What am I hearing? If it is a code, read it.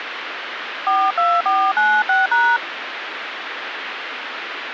DTMF, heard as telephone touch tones, dialled by hand, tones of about 230 ms, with phone line noise. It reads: 42496#